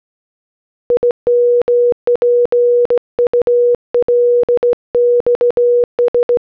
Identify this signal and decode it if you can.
Morse code (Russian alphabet), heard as a keyed tone, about 17 wpm, 480 Hz. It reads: ИМПУЛЬС